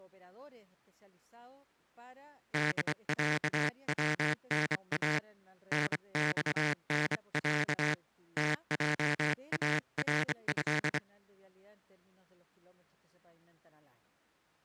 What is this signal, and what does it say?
Morse code (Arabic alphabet), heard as a buzzer, hand-sent with a straight key, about 25 wpm. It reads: دعونا نصنع تجاره